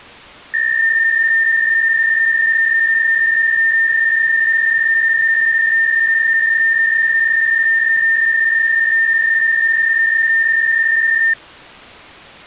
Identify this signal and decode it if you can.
PSK63 (62.5 baud), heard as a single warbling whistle, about 1800 Hz.